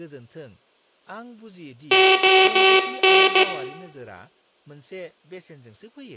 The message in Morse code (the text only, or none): ON